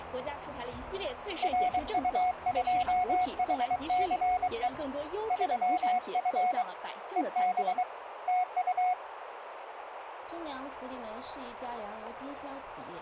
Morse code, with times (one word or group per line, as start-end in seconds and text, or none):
1.4-4.7 RU2HCE
5.3-6.6 3F
7.2-7.8 EB
8.3-8.9 TU